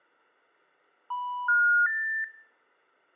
Telephone call progress tone (North American plan), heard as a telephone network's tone, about 980, 1430, 1800 Hz, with room echo. Special information tone.